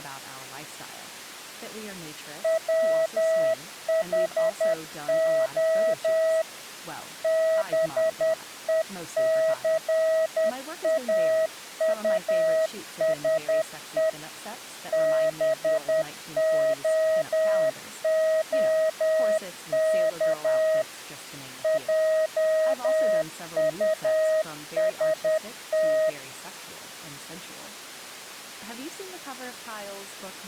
Morse code, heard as a keyed tone, machine-sent, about 10 wpm, 640 Hz, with speech in English. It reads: WHO BECAUSE BOOK JUST